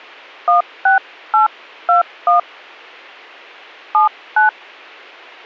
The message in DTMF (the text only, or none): 16821 79